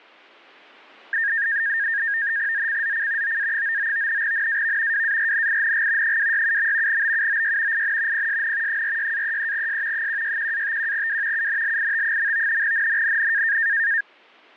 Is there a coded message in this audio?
Yes: NAVTEX (SITOR-B), 100 baud, 170 Hz shift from 1.1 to 14.0 s, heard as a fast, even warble, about 1750 Hz centre. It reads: ZCZC OA99 NAV WARNING 267. BUOY IN PSN 46-33S 161-51W UNLIT. NNNN